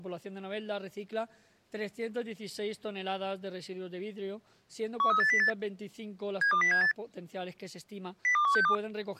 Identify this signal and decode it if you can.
Five-tone selective call (CCIR), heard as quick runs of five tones, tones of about 100 ms. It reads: 13808 72078 02162